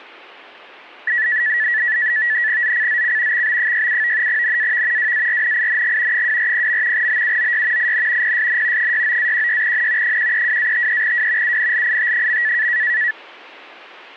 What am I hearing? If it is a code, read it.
NAVTEX (SITOR-B), 100 baud, 170 Hz shift, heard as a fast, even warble, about 1850 Hz centre. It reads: ZCZC XB67 NAV WARNING 240. BUOY IN PSN 69-16N 132-53W UNLIT.